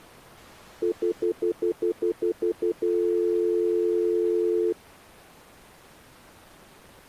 Telephone call progress tone (North American plan), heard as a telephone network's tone, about 350, 440 Hz, 0.1 s on and 0.1 s off. Stutter dial tone.